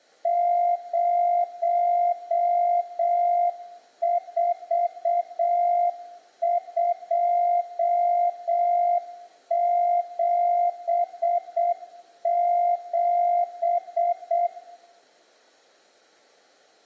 Morse code, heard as a keyed tone, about 7 wpm, 700 Hz, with room echo. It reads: 04277